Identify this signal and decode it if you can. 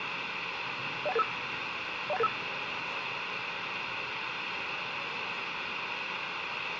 Five-tone selective call (EIA), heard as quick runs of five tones, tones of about 30 ms, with radio hiss and the noise of a subway station. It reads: 01885 01885